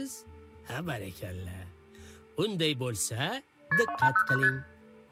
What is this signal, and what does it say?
Multi-frequency trunk signalling (R1, as on North American trunks), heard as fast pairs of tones, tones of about 70 ms, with room echo. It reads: KP 2809 ST